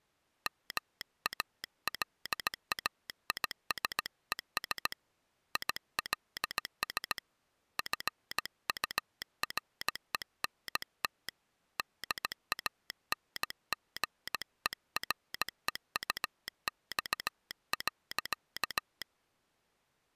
Morse code, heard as a telegraph sounder, hand-sent with a paddle, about 17 wpm. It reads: MALAISES ILS FURENT DANGEREUX.